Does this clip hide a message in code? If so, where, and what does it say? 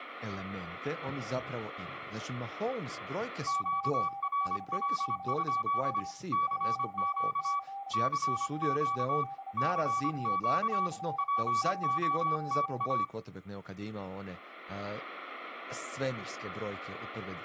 Yes: Morse code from 3.4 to 13.1 s, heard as two keyed tones, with room echo and speech in Croatian. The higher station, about 25 wpm, 1140 Hz: QRL? CQ CQ CQ POTA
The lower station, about 29 wpm, 800 Hz: VNK7W 1C GTL9 CIWKD